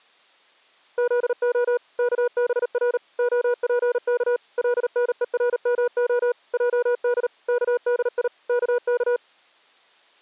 Morse code (Hebrew alphabet), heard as a keyed tone, machine-sent, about 38 wpm, 490 Hz. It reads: זה כבר הפך לנורמה עד כדי כך